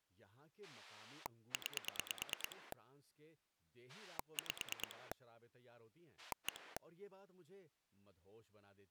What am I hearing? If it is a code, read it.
Pulse dialling, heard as a rotary dial, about 9 pulses a second, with speech in Urdu. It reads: 9 5 1